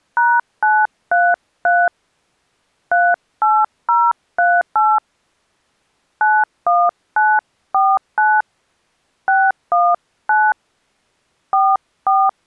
DTMF, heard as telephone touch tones, dialled by hand, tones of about 230 ms. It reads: #933 38038 91949 619 44